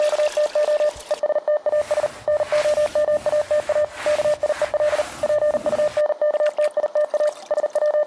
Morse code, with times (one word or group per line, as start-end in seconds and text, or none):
0.0-0.9 …
1.1-2.1 ESTAS
2.3-3.8 NOMATA
4.1-5.0 KIEL
5.2-7.3 PUNKTITA
7.5-8.1 …